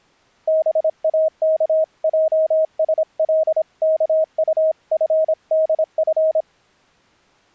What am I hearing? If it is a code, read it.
Morse code (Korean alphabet), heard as a keyed tone, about 26 wpm, 630 Hz. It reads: 동혁이는